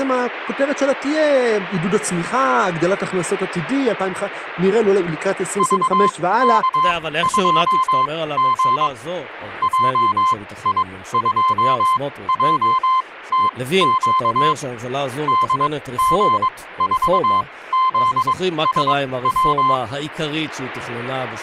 Morse code, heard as a keyed tone, machine-sent, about 22 wpm, spaced as for 16 wpm, 1040 Hz, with speech in Hebrew. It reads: VK2G JI2JTQ DG4ZSW